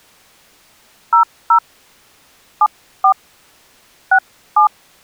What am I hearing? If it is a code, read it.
DTMF, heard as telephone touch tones, dialled by hand, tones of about 80 ms. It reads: 00 74 67